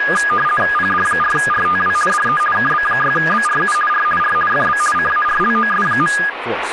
RTTY (50 baud, 450 Hz shift), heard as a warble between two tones, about 1440 Hz centre, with radio static and speech in English. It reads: PD4RTW DE KB6BRU R R FB CARLOS.